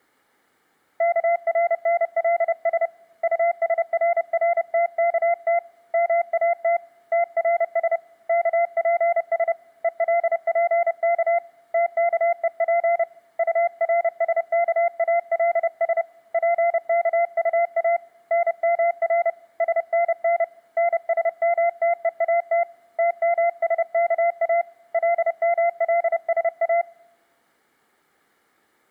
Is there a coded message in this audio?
Yes: Morse code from 0.9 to 26.9 s, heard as a keyed tone, hand-sent with a paddle, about 30 wpm, 690 Hz. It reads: KRNLS USRRTKT MAT TRS KPS ELPK TKEP URSKALS PKUA NMR SNN NSMTEAT TMSKA LMLSA